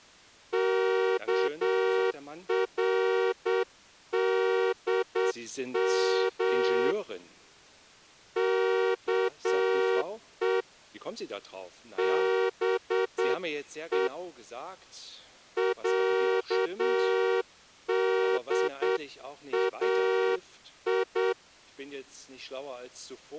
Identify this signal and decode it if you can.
Morse code (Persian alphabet), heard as a horn, hand-sent with a straight key, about 8 wpm. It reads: کردم که به صدای